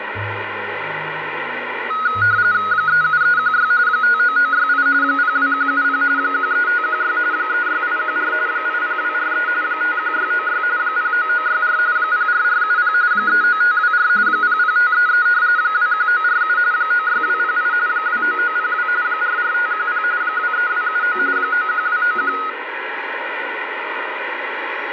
RTTY (45.45 baud, 170 Hz shift), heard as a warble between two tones, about 1360 Hz centre, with radio static. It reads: 37316 59968 02170 13516 36814 80243 51696 09964 04470 39524 00533 21947 96208 29902 44510 23279 91291